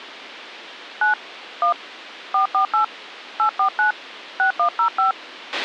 DTMF, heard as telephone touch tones, dialled by hand, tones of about 110 ms, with a squelch burst at the end. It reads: 9 1 448 849 6105